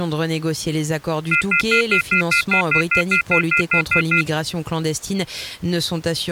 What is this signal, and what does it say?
Telephone call progress tone (North American plan), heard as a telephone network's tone, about 1400, 2050, 2450, 2600 Hz, 0.1 s on and 0.1 s off. Off-hook warning tone.